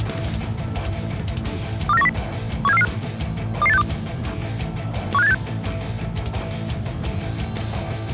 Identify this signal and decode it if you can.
Five-tone selective call (EEA), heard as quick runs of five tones, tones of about 40 ms. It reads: 24910 17445 22862 15786